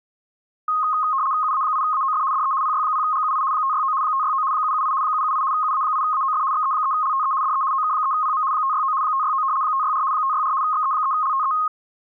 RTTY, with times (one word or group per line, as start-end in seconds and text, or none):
1.4-2.2 UA8AOF
2.3-2.5 DE
2.6-3.4 PY0GUI
3.5-3.9 569
4.0-4.4 569
4.5-4.9 778
5.0-5.4 778
5.5-6.4 UA8AOF
6.5-7.3 XE3LTE
7.4-7.6 DE
7.7-8.4 OK3PM
8.5-8.9 569
9.0-9.4 569
9.6-10.0 564
10.1-10.5 564
10.6-11.5 XE3LTE